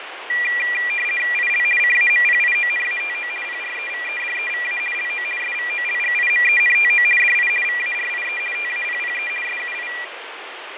RTTY (50 baud, 450 Hz shift), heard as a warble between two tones, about 2150 Hz centre, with radio static and fading. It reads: IL CAMPIONATO PREVEDEVA LO SVOLGIMENTO DI VARIE TAPPE SUI